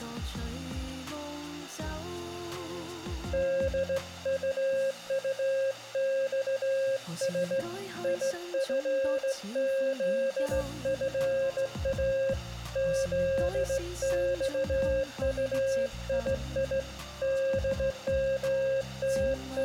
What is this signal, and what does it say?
Morse code, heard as a keyed tone, hand-sent with a straight key, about 16 wpm, 540 Hz, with room echo. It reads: DUUXS IFZFA ZXUII …